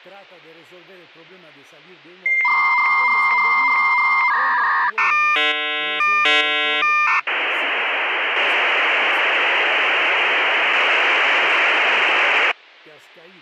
Dial-up modem handshake (V.34 or later), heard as a whistle, warbles, then hiss, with speech in Spanish.